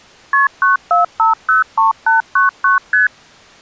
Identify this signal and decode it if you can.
Multi-frequency trunk signalling (R1, as on North American trunks), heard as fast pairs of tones, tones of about 140 ms. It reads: KP 94503899 ST